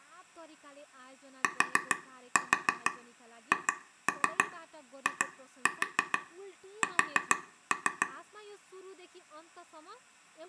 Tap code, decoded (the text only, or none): THIS